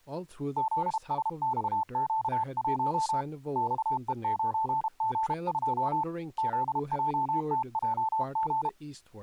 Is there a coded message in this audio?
Yes: Morse code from 0.5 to 8.8 s, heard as a keyed tone, hand-sent with a paddle, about 32 wpm, 880 Hz, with speech in English. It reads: ZSXQ1 XE9G2 ZJTJG